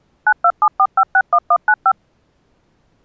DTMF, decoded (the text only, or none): 9274561195